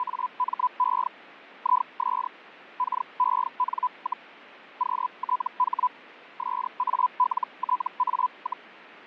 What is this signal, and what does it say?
Hellschreiber (Feld-Hell, 122.5 baud), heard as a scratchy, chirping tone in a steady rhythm, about 1000 Hz, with fading. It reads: … IS KEN, QTH SALTA,